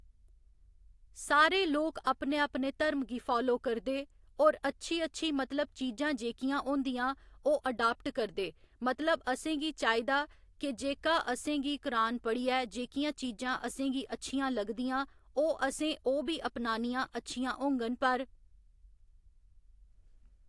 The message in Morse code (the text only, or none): none